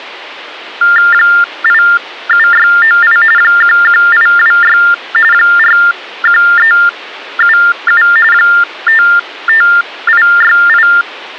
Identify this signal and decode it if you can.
TTY/TDD text telephone tones (45.45 baud Baudot), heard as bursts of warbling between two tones, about 400 Hz shift, 1600 Hz centre. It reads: 87698 11826 41377 55868